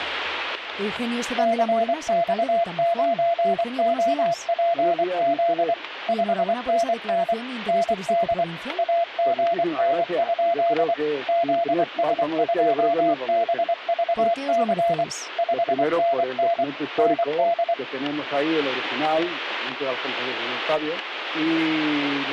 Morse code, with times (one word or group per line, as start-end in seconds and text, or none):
1.4-5.7 CX9OPZ
6.1-7.3 5NN
7.7-8.4 ND
8.8-10.9 AGN?
11.3-15.0 ZS2BVC
15.4-16.6 5NN
17.0-17.7 ND